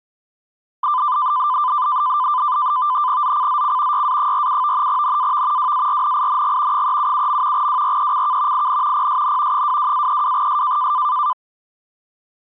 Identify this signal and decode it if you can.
NAVTEX (SITOR-B), 100 baud, 170 Hz shift, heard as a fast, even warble, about 1100 Hz centre. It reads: ZCZC YA47 NAV WARNING 377. WRECK IN PSN 22-32S